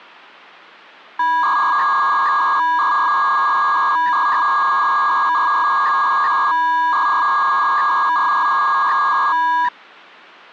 300-baud modem data (V.21 tones), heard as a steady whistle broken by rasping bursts, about 300 baud, 200 Hz shift.